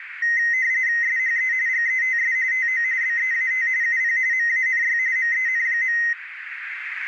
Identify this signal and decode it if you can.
RTTY (45.45 baud, 170 Hz shift), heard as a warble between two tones, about 1950 Hz centre, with radio static and a narrow filter. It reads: SHE GETS TO BEAT UP MANY MEN.